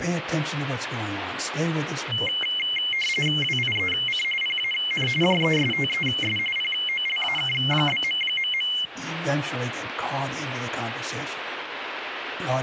RTTY (45.45 baud, 850 Hz shift), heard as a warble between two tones, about 2550 Hz centre, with radio static. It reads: WIEC PAN JESTES POLAK?...